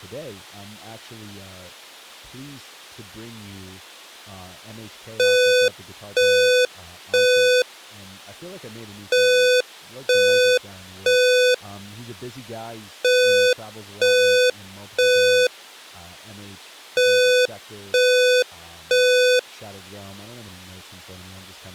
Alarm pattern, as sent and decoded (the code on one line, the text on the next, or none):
3 beeps and a pause
temporal three